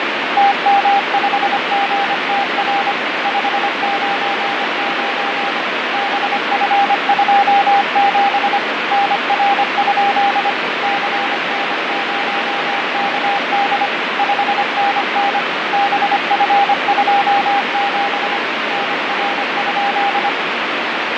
Morse code, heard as a keyed tone, machine-sent, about 25 wpm, 800 Hz, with heavy radio static and fading. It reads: TM5GTR 599 BF27 NR? CN0KD 5NN BF27 NR?